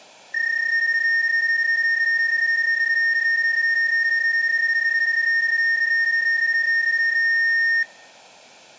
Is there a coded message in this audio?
Yes: PSK31 (31.25 baud) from 0.3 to 7.8 s, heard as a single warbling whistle, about 1850 Hz, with room echo.